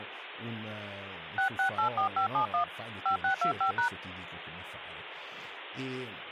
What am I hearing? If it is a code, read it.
DTMF, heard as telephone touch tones, dialled by hand, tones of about 100 ms, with phone line noise and speech in Italian. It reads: 6684571 5625#